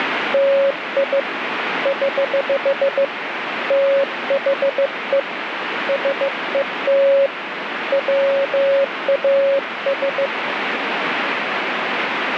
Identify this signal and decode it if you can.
Morse code, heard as a keyed tone, hand-sent with a bug key, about 15 wpm, 550 Hz, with radio static. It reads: TI <HH> THE SET WAS